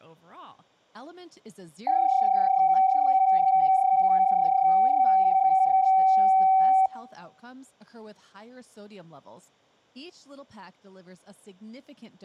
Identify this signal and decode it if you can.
PSK31 (31.25 baud), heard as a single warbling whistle, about 760 Hz, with room echo and speech in English.